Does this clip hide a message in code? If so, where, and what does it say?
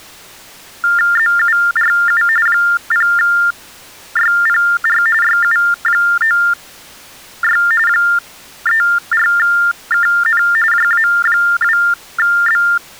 Yes: TTY/TDD text telephone tones (45.45 baud Baudot) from 0.8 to 12.8 s, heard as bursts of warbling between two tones, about 400 Hz shift, 1600 Hz centre. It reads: ZURU 0YPR YU96 34KN JA2B